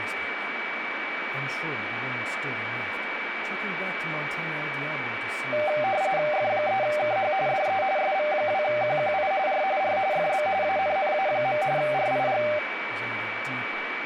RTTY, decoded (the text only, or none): F3KH DE SV2QQI R R FB ANNA. RIG